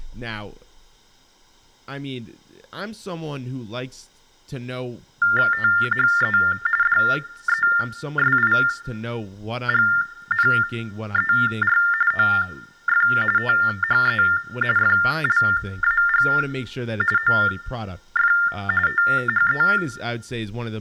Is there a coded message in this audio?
Yes: TTY/TDD text telephone tones (45.45 baud Baudot) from 5.2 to 19.8 s, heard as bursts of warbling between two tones, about 400 Hz shift, 1600 Hz centre, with speech in English. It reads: THE DESIGNER OF THE FLAG OF THE